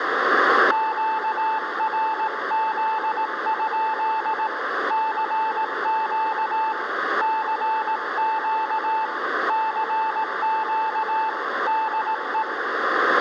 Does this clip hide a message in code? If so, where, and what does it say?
Yes: Morse code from 0.7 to 12.5 s, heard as a keyed tone, hand-sent with a paddle, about 18 wpm, 880 Hz, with room echo. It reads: QRZ? CQ CQ CQ DE